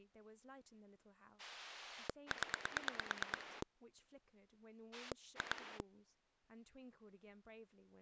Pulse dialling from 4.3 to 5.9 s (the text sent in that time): 2